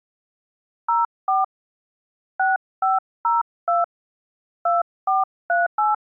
DTMF, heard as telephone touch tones, dialled by hand, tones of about 170 ms. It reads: 04 6502 2438